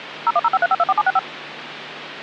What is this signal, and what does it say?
DTMF, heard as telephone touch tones, dialled by machine, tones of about 40 ms, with phone line noise. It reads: 01053524765